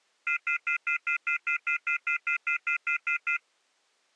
Telephone call progress tone (North American plan), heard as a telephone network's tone, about 1400, 2050, 2450, 2600 Hz, 0.1 s on and 0.1 s off. Off-hook warning tone.